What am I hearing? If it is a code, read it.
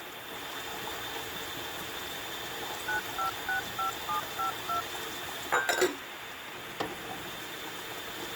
DTMF, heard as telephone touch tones, dialled by machine, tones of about 120 ms, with phone line noise and kitchen noise. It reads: 9565752